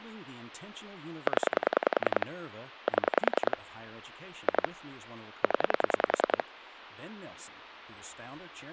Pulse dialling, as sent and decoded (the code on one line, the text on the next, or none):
10 / 7 / 2 / 10
0 7 2 0